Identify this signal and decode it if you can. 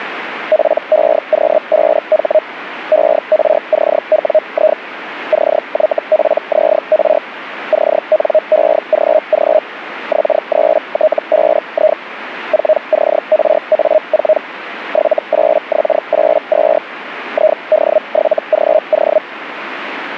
Hellschreiber (Feld-Hell, 122.5 baud), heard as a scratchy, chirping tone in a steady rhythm, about 620 Hz. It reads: PEQ5H ERCWI CYPZR CNEGG X3T5I 4CRA4 78X82 ID7GO